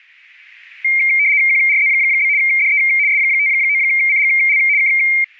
RTTY (75 baud, 170 Hz shift), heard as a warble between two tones, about 2200 Hz centre, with static crashes. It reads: QRZ? DE S59CGL K